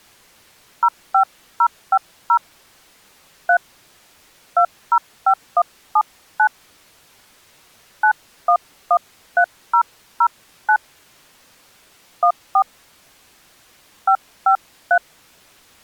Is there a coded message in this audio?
Yes: DTMF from 0.8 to 15.0 s, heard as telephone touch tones, dialled by hand, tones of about 70 ms. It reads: 05050 3 205179 9113009 14 553